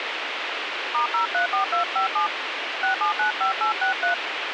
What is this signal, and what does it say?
DTMF, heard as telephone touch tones, dialled by hand, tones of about 120 ms, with radio hiss. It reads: *034257 6795863